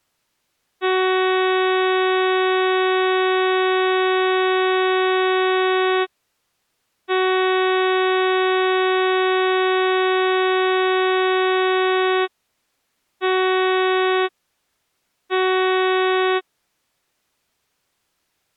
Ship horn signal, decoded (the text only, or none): 2 long, 2 short